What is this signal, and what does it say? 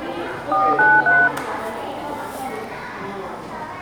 DTMF, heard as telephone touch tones, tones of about 220 ms, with room echo and the noise of a crowd indoors. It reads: 493